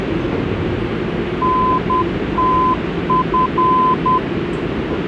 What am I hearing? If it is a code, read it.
Morse code, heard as a keyed tone, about 10 wpm, 1020 Hz, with radio static and the noise inside a subway train. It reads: NTF